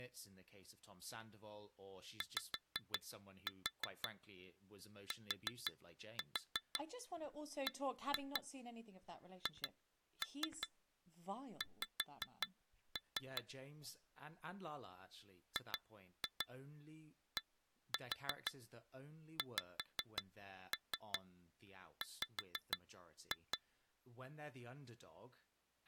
Tap code, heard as taps on glass, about 5 knocks a second, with speech in English. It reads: YTBHX GDXW